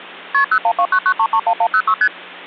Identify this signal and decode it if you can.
Multi-frequency trunk signalling (R1, as on North American trunks), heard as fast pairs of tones, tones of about 70 ms, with hum. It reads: KP 01299331106 ST